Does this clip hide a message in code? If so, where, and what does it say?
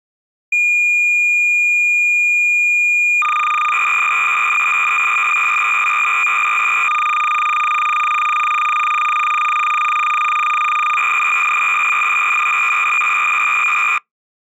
Yes: cassette data (Kansas City type), 300 baud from 0.5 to 14.0 s, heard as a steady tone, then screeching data.